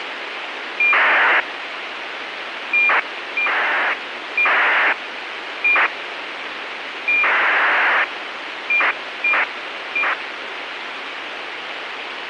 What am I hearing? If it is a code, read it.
ACARS aircraft data, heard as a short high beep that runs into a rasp, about 2400 baud, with radio hiss.